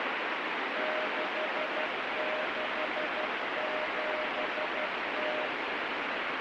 Morse code (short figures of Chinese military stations), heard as a keyed tone, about 12 wpm, 620 Hz, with heavy radio static. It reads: 6670